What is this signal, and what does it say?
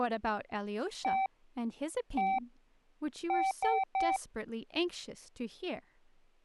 Beep code, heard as beeps, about 770 Hz, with speech in English. 1-1-3. In Phoenix BIOS tables: CMOS read or write failure.